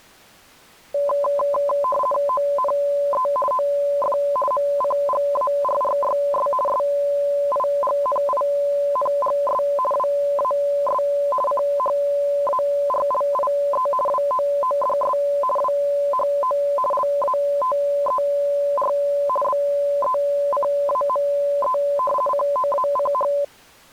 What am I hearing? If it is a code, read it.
RTTY (50 baud, 450 Hz shift), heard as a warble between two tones, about 800 Hz centre. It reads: ONE OF MCGARRYS SIGNINGS WAS CHARLIE WOODS WHO LATER BECAME COACH